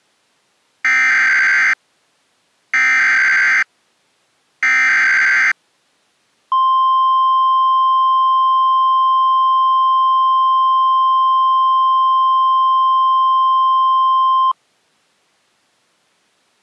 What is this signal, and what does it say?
Emergency Alert System (SAME) tones (header bursts, then the 1050 Hz attention tone), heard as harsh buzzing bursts, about 520.83 baud.